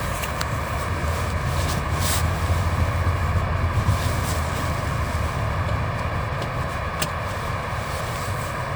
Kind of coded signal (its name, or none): Morse code